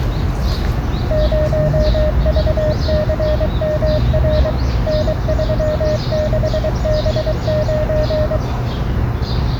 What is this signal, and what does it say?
Morse code, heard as a keyed tone, machine-sent, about 23 wpm, 610 Hz, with the noise of a park. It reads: 0VCMR N36B9